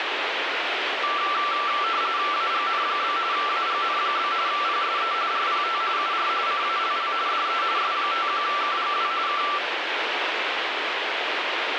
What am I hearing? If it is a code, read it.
RTTY (45.45 baud, 170 Hz shift), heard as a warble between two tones, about 1260 Hz centre, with radio static. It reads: AGN? AGN? PSE RPT UR CALL DE S51KGW K